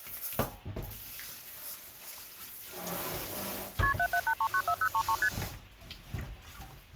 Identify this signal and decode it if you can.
Multi-frequency trunk signalling (R1, as on North American trunks), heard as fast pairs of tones, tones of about 70 ms, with kitchen noise. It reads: KP 778394033 ST